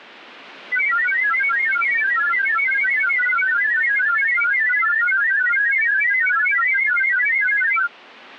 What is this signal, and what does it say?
Multi-tone FSK (Olivia or MFSK type), about 1000 Hz wide, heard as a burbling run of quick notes, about 31.25 baud.